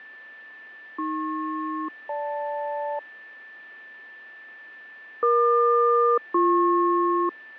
Aircraft SELCAL, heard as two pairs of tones, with fading and a steady whistle near 1770 Hz. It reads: AP-GL EQ-BP